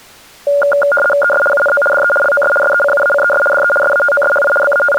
RTTY (75 baud, 850 Hz shift), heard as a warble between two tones, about 1000 Hz centre. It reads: ES UNO DE LOS SECUACES DE SATOSHI …